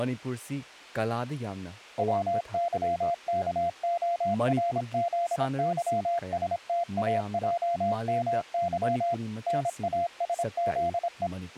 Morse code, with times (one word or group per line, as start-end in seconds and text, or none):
2.0-9.1 WYKORZYSTAJMY
9.5-11.3 NASZE